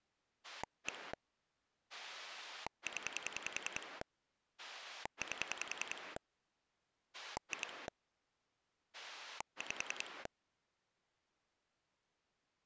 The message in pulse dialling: 1 0 8 2 5

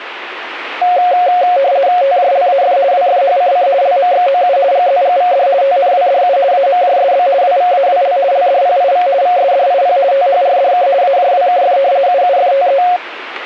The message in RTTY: TJLAF WFHCC LMXOU GZGVD TNWDU AMJSB WVAWL LDPIV VSDIP THRDK AJWKF UUFTE

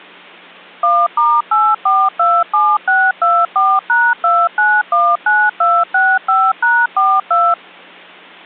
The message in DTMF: 1*8427624#2919265#42

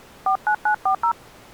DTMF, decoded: 49940

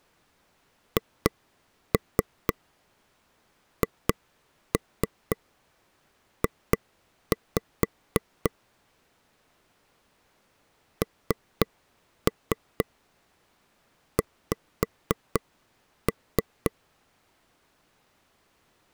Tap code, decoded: HHJ NX

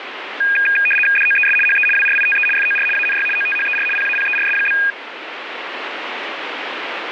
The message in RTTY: DOES HE WRITE FOR ANY OTHER PAPERS?

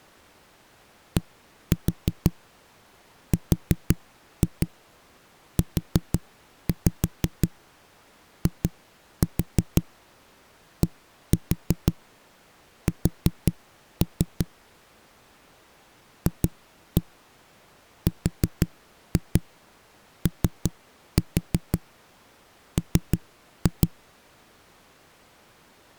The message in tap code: DRUIDS FROM

